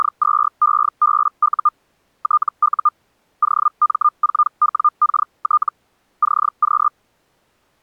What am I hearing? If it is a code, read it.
Hellschreiber (Feld-Hell, 122.5 baud), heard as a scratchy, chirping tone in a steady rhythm, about 1210 Hz. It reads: … TU OM4WKT CQ